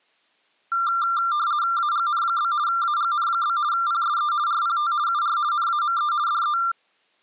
RTTY (50 baud, 170 Hz shift), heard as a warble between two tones, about 1280 Hz centre. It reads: AGN? AGN? PSE RPT UR NAME DE